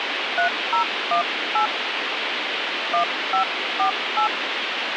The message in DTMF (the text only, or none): 3018 1548